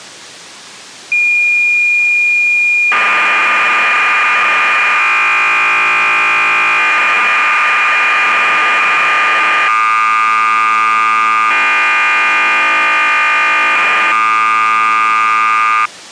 Cassette data (Kansas City type), 1200 baud, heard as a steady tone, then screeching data.